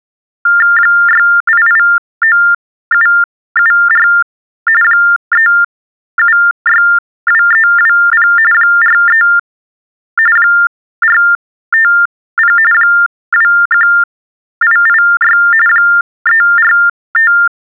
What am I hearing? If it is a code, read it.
TTY/TDD text telephone tones (45.45 baud Baudot), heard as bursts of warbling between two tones, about 400 Hz shift, 1600 Hz centre. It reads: 6889774 3762320 43 450 21886 345